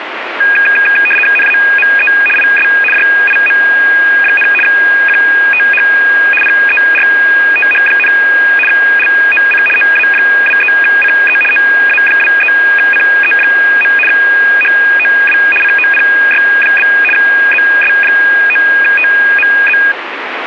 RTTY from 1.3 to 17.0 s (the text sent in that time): NAME IS JIM, QTH PERTH, LOC OA23CE OA23CE. HOW COPY?